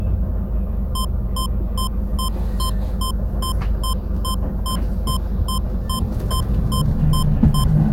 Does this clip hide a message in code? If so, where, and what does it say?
No, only evenly repeated beeps, with the noise inside a bus.